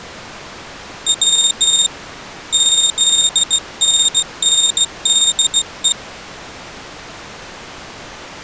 Morse code (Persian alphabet), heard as a high beeper, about 16 wpm, 3650 Hz. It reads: و زننده